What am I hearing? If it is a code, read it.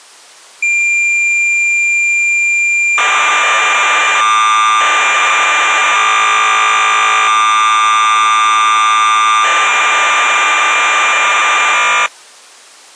Cassette data (Kansas City type), 1200 baud, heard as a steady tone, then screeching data.